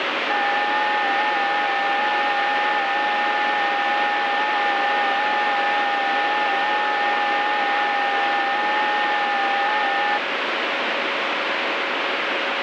FT8 (several signals at once), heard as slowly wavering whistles, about 6.25 baud, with heavy radio static.